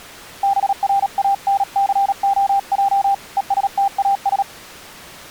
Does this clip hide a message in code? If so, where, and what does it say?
Yes: Morse code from 0.4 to 4.5 s, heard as a keyed tone, hand-sent with a paddle, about 37 wpm, 790 Hz. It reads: BRANCOJ ESTAS